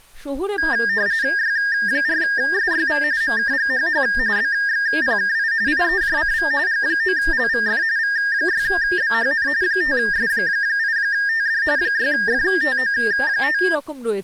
RTTY (45.45 baud, 170 Hz shift), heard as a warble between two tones, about 1700 Hz centre, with speech in Bangla. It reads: Y4SYV MKGHH BXPKI IEJCV G9LVF V6BHN 5S8TD 6FTO5